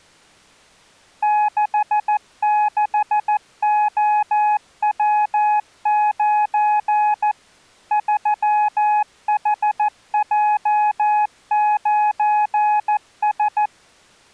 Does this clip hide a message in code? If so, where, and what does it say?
Yes: Morse code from 1.2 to 13.7 s, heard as a keyed tone, machine-sent, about 14 wpm, 840 Hz. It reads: 66OW9 3HJ9S